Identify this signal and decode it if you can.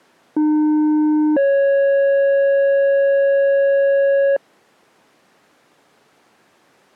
Two-tone page, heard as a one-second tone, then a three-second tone, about 300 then 550 Hz.